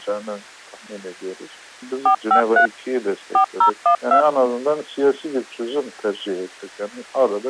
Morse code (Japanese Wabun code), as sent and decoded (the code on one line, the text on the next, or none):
none